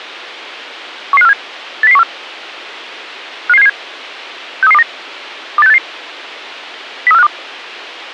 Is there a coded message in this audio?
Yes: five-tone selective call (EEA) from 1.1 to 7.3 s, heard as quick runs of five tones, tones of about 40 ms. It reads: 11547 80014 55777 63329 28688 03452